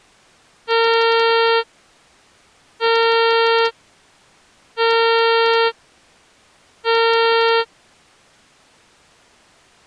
Ship horn signal, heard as a ship's horn, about 460 Hz. 4 short. At sea: a pilot vessel's identity signal in fog.